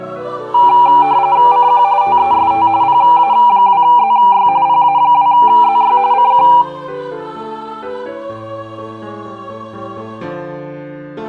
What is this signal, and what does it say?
RTTY (45.45 baud, 170 Hz shift), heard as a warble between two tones, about 880 Hz centre, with room echo. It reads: CQ TEST PA2ZY PA2ZY CQ